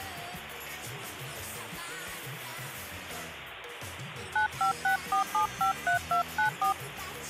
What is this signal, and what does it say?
DTMF, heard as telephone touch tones, dialled by hand, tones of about 110 ms, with phone line noise. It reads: 9564753294